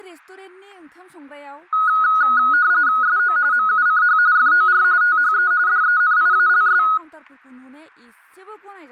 RTTY (45.45 baud, 170 Hz shift), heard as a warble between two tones, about 1360 Hz centre, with speech in Bodo. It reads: SO MUCH FOR THE DENIALS